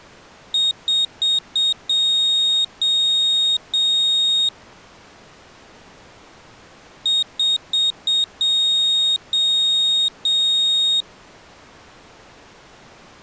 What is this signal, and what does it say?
Beep code, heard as a piezo beeper, played twice, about 3750 Hz. 4 short, 3 long.